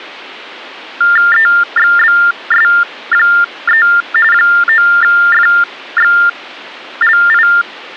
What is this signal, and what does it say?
TTY/TDD text telephone tones (45.45 baud Baudot), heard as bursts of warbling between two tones, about 400 Hz shift, 1600 Hz centre. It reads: EXBS3 9FXLI